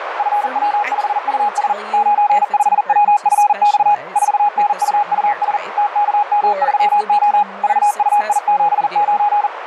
Morse code, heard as a keyed tone, machine-sent, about 40 wpm, 830 Hz, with radio static, a narrow filter and speech in English. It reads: FW5US 95WFX 4NUUS TKM3O VUI79